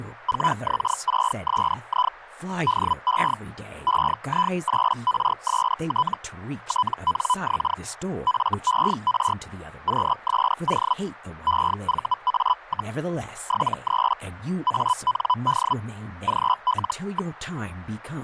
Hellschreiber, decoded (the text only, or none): 4X6SI DE EI8RST TNX FER QSO EVA, 73 AND GL.